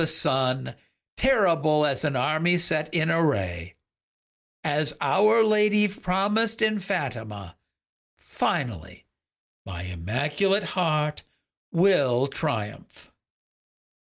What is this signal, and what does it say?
Speech in English. There is no code.